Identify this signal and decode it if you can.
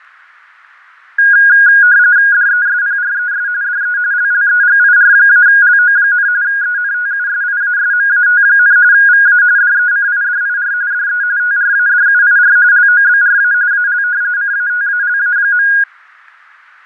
RTTY (45.45 baud, 170 Hz shift), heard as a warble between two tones, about 1550 Hz centre, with fading and static crashes. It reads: DESPRES DE LLEGIR-LO, ENTUSIASMAT, VA DECIDIR DE TRADUIR LOBRA AL CATALA.